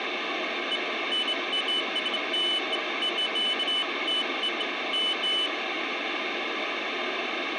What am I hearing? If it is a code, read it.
Beeps of irregular length, with radio hiss. There is no code.